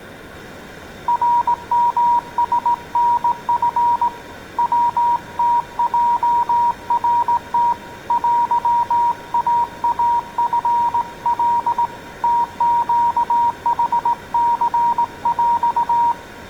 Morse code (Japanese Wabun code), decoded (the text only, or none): ナヨラタチ ヤムヲナム テイイチカ ムネヌニヰ